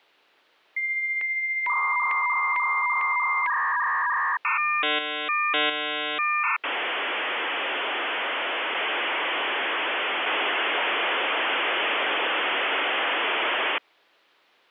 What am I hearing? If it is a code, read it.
Dial-up modem handshake (V.34 or later), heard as a whistle, warbles, then hiss.